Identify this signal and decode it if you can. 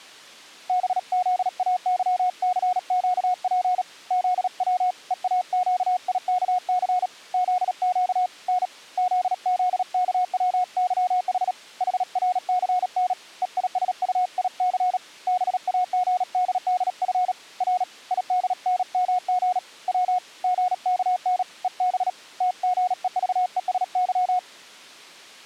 Morse code, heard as a keyed tone, hand-sent with a paddle, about 37 wpm, 730 Hz. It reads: BZAYCQP ZW EAQIKC ZQ N ZZKWYH HRCN EISUIC BAGDDF R IDNMG W GKN EB TGEVESY